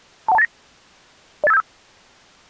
Five-tone selective call (EIA), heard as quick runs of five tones, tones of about 30 ms. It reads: 21289 08575